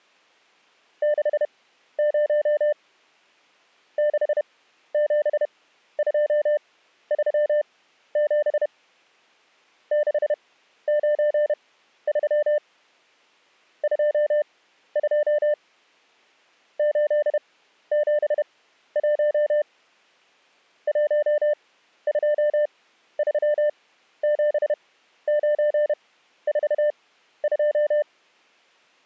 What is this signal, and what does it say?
Morse code, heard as a keyed tone, machine-sent, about 31 wpm, spaced as for 13 wpm, 600 Hz. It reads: 60 67237 693 22 871 1237942